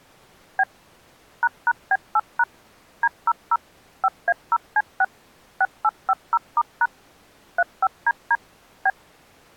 DTMF, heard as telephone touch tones, dialled by machine, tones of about 50 ms. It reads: B ##B8# D00 5A0C6 6850*# 35DD B